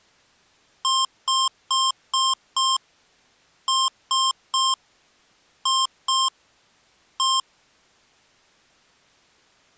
Beep code, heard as beeps from a small speaker, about 1060 Hz. 5-3-2-1.